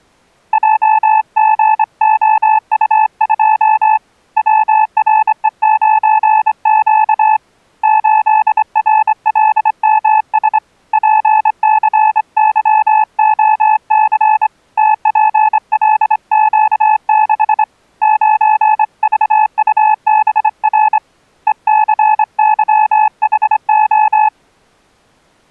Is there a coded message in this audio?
Yes: Morse code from 0.5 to 24.3 s, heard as a keyed tone, hand-sent with a straight key, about 25 wpm, 860 Hz. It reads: JGOU2 WRE9Q 8RLMS PCYOC TPLQ6 9VUBR ECYHO